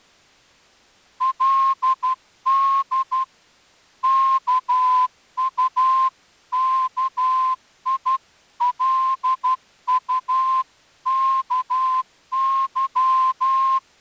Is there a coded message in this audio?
Yes: Morse code (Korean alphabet) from 1.2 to 13.8 s, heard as a whistle, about 12 wpm. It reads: 그 이야기에